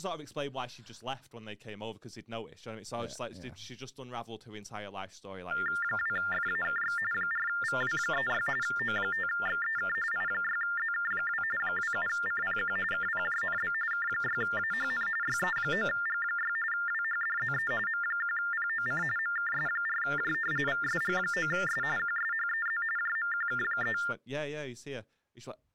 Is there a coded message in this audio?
Yes: TTY/TDD text telephone tones (45.45 baud Baudot) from 5.5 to 24.1 s, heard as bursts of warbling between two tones, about 400 Hz shift, 1600 Hz centre, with speech in English. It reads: 2FAKX 4VW36 O5XEK I6ZK2 27CPQ KPJNB K6AHN YE9G6 WHDZE M1POC MKS4J VSG9S QSHEZ JMQK3